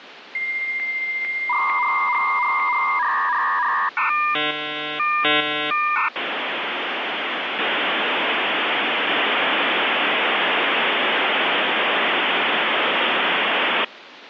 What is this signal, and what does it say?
Dial-up modem handshake (V.34 or later), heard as a whistle, warbles, then hiss, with phone line noise.